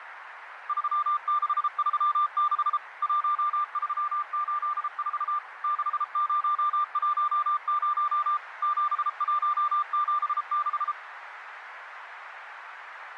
Morse code, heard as a keyed tone, machine-sent, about 33 wpm, 1190 Hz, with radio static and a narrow filter. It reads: 3636 1384 6010 7176